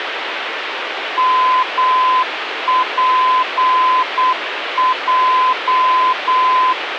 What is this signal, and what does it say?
Morse code, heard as a keyed tone, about 8 wpm, 1020 Hz, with radio static. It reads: MPJ